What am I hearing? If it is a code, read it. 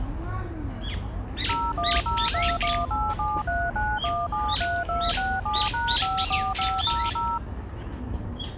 DTMF, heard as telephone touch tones, dialled by machine, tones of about 230 ms, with the noise of a residential street. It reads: 010218739173267#54500